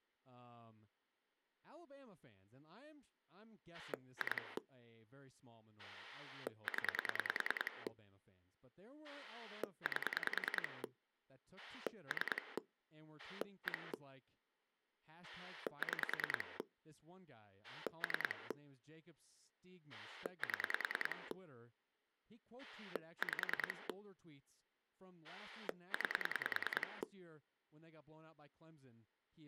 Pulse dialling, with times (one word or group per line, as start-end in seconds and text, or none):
3.7-4.6 2
5.8-7.9 0
9.0-10.8 8
11.6-12.6 3
13.2-13.9 1
15.2-16.6 6
17.6-18.5 3
19.9-21.3 7
22.6-23.9 5
25.2-27.0 9